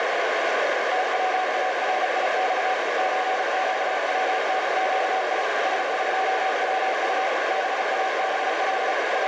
Morse code (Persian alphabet), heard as a keyed tone, machine-sent, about 35 wpm, 760 Hz, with heavy radio static and a narrow filter. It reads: تواریخ چگونگی سقوط بابل …